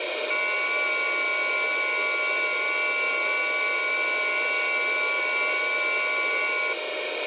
FT8 (several signals at once), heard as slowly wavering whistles, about 6.25 baud, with radio static.